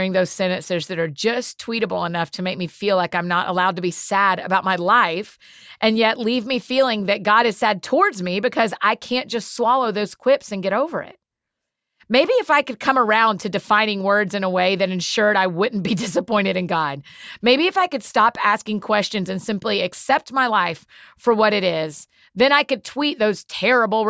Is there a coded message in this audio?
No.